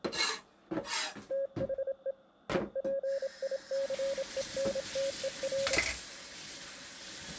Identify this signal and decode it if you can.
Morse code, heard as a keyed tone, hand-sent with a paddle, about 27 wpm, 550 Hz, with kitchen noise. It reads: THE EPICENTER